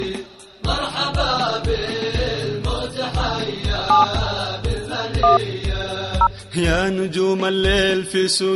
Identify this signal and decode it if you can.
DTMF, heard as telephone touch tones, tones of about 100 ms. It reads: 7 1 0